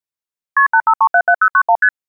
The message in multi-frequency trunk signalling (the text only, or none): KP 85377091 ST